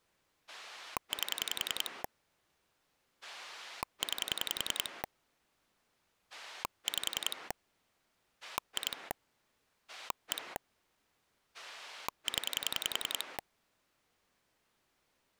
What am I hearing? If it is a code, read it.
Pulse dialling, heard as a rotary dial, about 10 pulses a second. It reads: 8 9 5 2 1 0